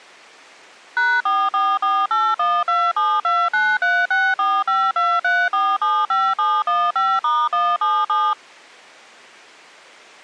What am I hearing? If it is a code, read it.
DTMF, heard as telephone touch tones, dialled by machine, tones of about 240 ms. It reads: #444812729364523475715*177